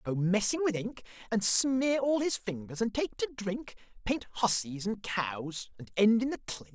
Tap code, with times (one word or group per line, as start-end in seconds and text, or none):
none